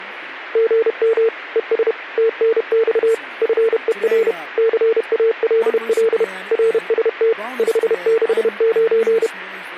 Morse code, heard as a keyed tone, machine-sent, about 31 wpm, 450 Hz, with speech in English. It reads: GM ES TNX FER CALL RST 569